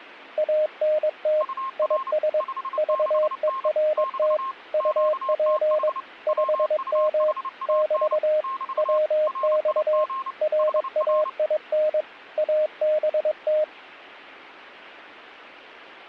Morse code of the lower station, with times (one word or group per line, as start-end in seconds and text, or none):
0.4-1.4 ANT
1.8-2.4 IS
2.8-4.4 VERT
4.7-5.9 UP
6.3-7.3 5M
7.7-8.4 <BT>
8.8-10.0 WX
10.4-12.0 RAIN
12.4-13.6 ABT